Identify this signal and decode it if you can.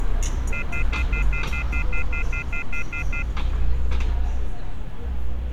Telephone call progress tone (North American plan), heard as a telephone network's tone, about 1400, 2050, 2450, 2600 Hz, 0.1 s on and 0.1 s off, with street noise. Off-hook warning tone.